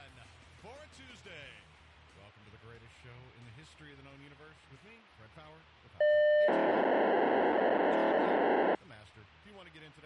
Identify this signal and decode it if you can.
POCSAG pager data (1200 baud), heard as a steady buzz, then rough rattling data.